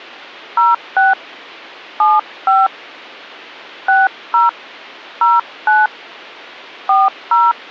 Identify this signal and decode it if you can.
DTMF, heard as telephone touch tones, dialled by hand, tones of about 190 ms. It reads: 06 75 60 09 40